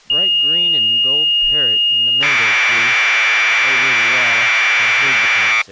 Commodore tape loading (standard loader), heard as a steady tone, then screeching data, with speech in English.